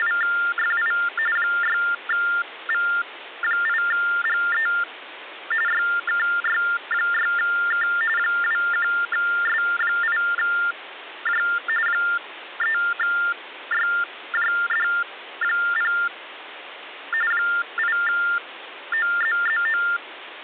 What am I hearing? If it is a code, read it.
TTY/TDD text telephone tones (45.45 baud Baudot), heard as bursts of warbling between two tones, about 400 Hz shift, 1600 Hz centre, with phone line noise. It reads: … 6V8GE YKY6K 21S8J 3YJD0 8OZZO